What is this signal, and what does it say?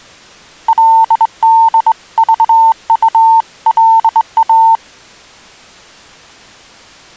Morse code (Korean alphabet), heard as a keyed tone, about 21 wpm, 900 Hz. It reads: 그리고